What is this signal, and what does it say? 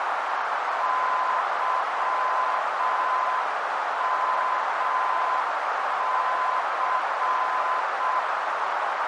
Morse code, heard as a keyed tone, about 6 wpm, 1020 Hz, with heavy radio static and a narrow filter. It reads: YMC